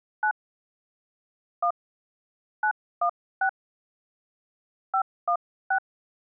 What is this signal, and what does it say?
DTMF, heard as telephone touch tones, dialled by hand, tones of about 80 ms. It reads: 9 1 916 516